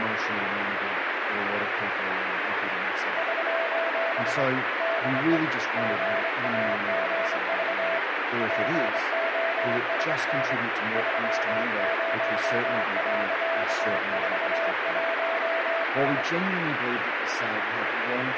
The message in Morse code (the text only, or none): <SOS> DE GAGV POSN 30.41S